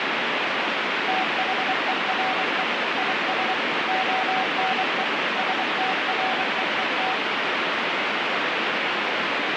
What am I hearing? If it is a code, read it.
Morse code, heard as a keyed tone, machine-sent, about 24 wpm, 760 Hz, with heavy radio static. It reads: THERE IS ONE STREET